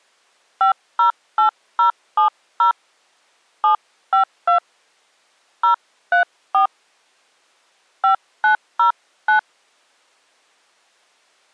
DTMF, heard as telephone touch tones, dialled by hand, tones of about 110 ms. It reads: 508070 752 034 5909